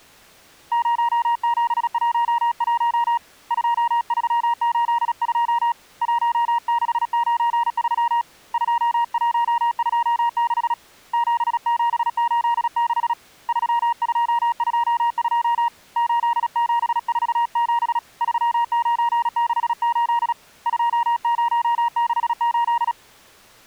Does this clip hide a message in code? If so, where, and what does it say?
Yes: Morse code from 0.7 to 23.0 s, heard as a keyed tone, hand-sent with a paddle, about 36 wpm, 940 Hz. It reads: 0711 2382 1693 2126 7786 3222 8747 3968 2068